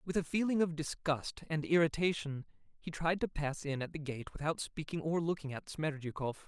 Speech in English. There is no code.